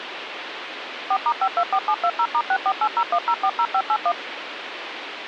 DTMF, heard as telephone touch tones, dialled by machine, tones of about 60 ms, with phone line noise. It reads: 4*524720*64801040581